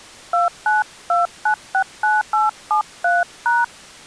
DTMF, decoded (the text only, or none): 292969873#